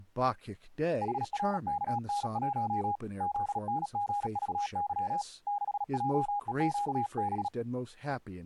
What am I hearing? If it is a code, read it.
Morse code, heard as a keyed tone, hand-sent with a paddle, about 37 wpm, 820 Hz, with speech in English. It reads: HRKN1 ZNGVY 6JEQB